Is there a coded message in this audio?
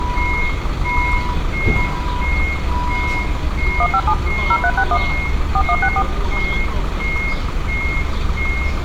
Yes: DTMF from 3.8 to 6.0 s, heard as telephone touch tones, dialled by machine, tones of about 60 ms, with street noise. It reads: 157 0361 4164